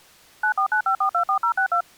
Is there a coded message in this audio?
Yes: DTMF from 0.4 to 1.8 s, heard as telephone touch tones, dialled by machine, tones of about 90 ms. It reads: 9495424062